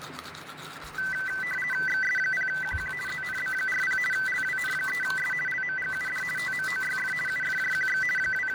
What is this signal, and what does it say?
RTTY (50 baud, 450 Hz shift), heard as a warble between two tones, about 1750 Hz centre, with radio static, fading and the noise of a restroom. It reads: XS0QQ ZNB40 LWN3S LMGUD TMOYF UFJQX …